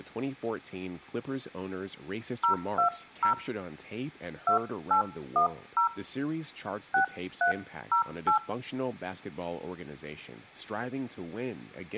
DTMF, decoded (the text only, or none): 020 2810 6308